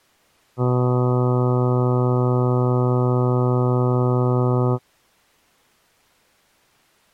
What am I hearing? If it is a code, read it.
Ship horn signal, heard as a ship's horn, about 120 Hz. 1 long. At sea: a vessel nearing a blind bend, or under power and making way in fog.